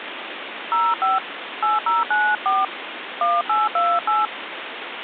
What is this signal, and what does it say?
DTMF, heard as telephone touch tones, dialled by hand, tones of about 200 ms, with phone line noise. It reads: 05 8094 1828